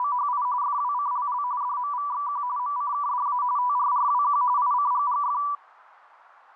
RTTY (45.45 baud, 170 Hz shift), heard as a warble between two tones, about 1070 Hz centre, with radio static. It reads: … FWCLL DMVXQ MCKDA TRRWQ ICGGF